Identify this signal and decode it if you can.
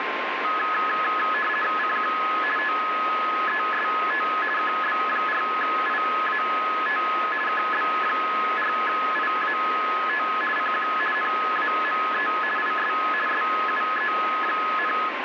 RTTY (50 baud, 450 Hz shift), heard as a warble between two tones, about 1490 Hz centre, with radio static and a steady whistle near 1060 Hz. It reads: CQ TEST KB4IAT KB4IAT CQ NAME IS SUE,